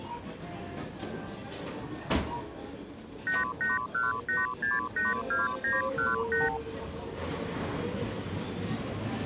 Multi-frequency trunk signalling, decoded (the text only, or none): 8818682918